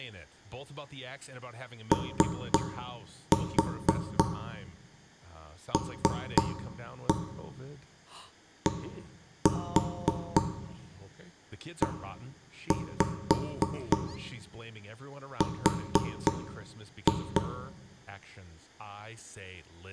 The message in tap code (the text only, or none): OLDER